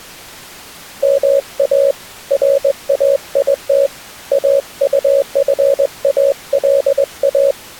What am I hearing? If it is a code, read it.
Morse code (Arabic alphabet), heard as a keyed tone, hand-sent with a straight key, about 20 wpm, 550 Hz. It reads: ما رايت اطفالا